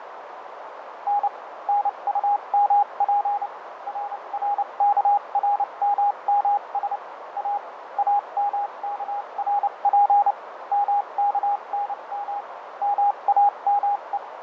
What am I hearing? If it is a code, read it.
Morse code, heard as a keyed tone, machine-sent, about 29 wpm, spaced as for 25 wpm, 820 Hz, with radio static, fading and a narrow filter. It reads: N NUMP RRKRMMS A AMKRP MKNM MAME